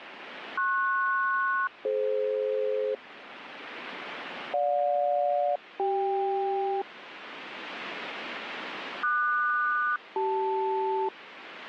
Aircraft SELCAL, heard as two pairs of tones, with radio static. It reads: PS-DF GJ-CK QS-CL